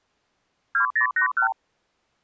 Multi-frequency trunk signalling (R2, with the far end's replies), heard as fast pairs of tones, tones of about 100 ms. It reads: 2081